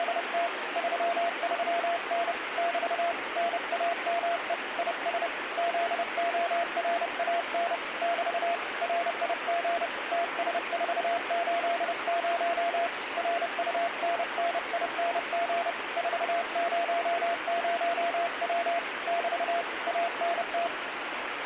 Morse code, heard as a keyed tone, hand-sent with a paddle, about 30 wpm, 680 Hz, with radio static. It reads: … 33N <BT> NAME IS ZORAN <BT> RIG TS480 RUNNING 400W <BT> ANT